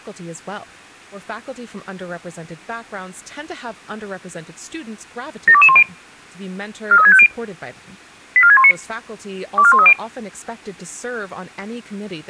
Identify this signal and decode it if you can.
Five-tone selective call (ZVEI), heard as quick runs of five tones, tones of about 70 ms, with speech in English. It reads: 72210 43650 84619 24130